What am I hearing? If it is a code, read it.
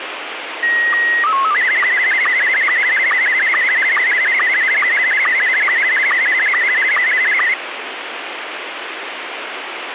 SSTV (slow-scan television), Scottie S1, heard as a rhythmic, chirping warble, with radio hiss.